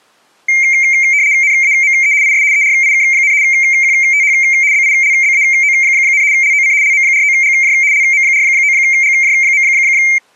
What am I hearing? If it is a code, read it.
RTTY (75 baud, 170 Hz shift), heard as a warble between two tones, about 2200 Hz centre. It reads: NAME IS ERIK, QTH BILBAO, LOC LM49GJ LM49GJ.